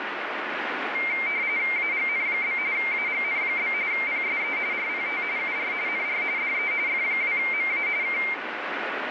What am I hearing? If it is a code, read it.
RTTY (45.45 baud, 170 Hz shift), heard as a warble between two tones, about 2200 Hz centre, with radio static. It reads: AGN? AGN? PSE RPT UR NR DE F2MA K